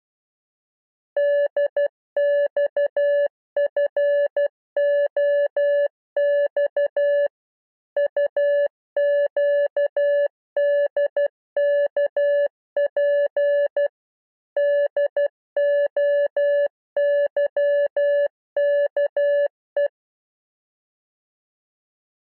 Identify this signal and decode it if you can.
Morse code, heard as a keyed tone, machine-sent, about 12 wpm, 580 Hz. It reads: DXFOX UQDKP DOYKE